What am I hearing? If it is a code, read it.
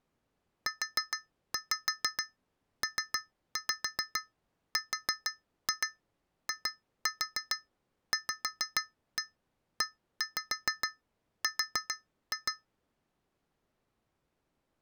Tap code, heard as taps on glass, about 6 knocks a second. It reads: UPRIVER